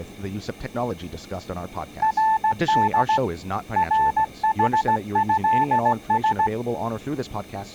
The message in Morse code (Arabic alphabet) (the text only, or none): رد رحهس